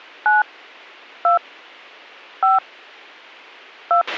DTMF, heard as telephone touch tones, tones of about 110 ms, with a squelch burst at the end. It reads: 9 2 5 2